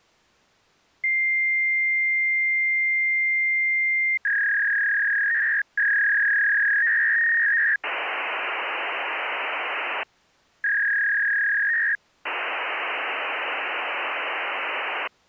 Fax machine handshake, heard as a long tone, a warble and hiss.